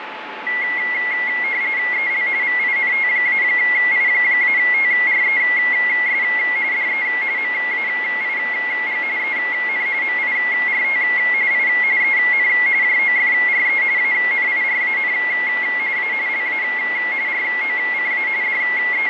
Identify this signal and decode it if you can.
RTTY (45.45 baud, 170 Hz shift), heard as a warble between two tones, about 2050 Hz centre, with radio static and a steady whistle near 870 Hz. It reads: EL VINT-I-TRES DE MAIG EN MIRT I EN JOFRE ANIRAN A LA ROCA …